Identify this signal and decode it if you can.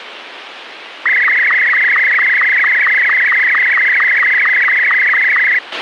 SSTV (slow-scan television), Martin M2, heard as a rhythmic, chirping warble, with radio hiss and a squelch burst at the end.